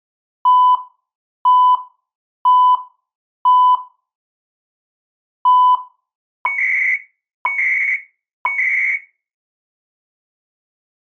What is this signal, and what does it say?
Radio time signal (CHU, Canada), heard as beeps and data bursts, one a second.